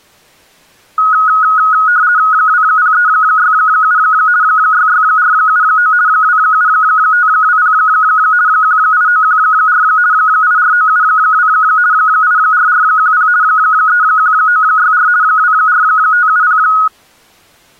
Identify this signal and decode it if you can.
RTTY (50 baud, 170 Hz shift), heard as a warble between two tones, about 1360 Hz centre. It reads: 20367 66479 27520 18914 84972 84410 31964 24570